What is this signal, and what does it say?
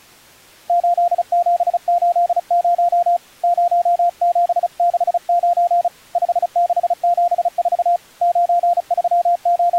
Morse code, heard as a keyed tone, hand-sent with a paddle, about 35 wpm, 700 Hz. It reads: 8780 0769 5674 …